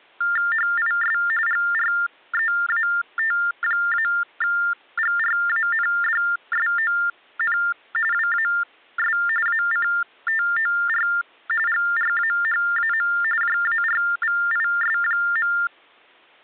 TTY/TDD text telephone tones (45.45 baud Baudot), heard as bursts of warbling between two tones, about 400 Hz shift, 1600 Hz centre. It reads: HIS GREAT-GRANDSON WAS ACTOR GRAHAM JARVIS.